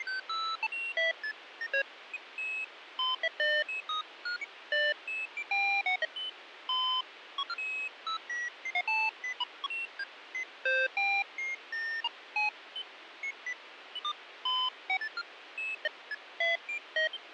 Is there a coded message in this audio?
No, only electronic bleeps of random pitch and length, with radio hiss.